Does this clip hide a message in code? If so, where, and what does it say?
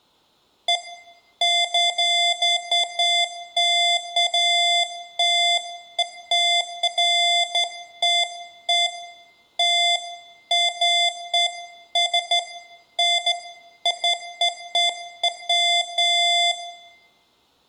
No, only beeps of irregular length, with room echo.